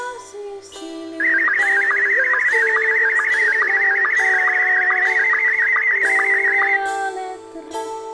SSTV (slow-scan television), Scottie S1, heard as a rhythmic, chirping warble.